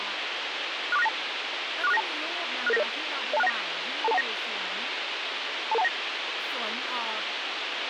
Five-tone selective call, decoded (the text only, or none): 64692 64692 66990 02619 22219 22219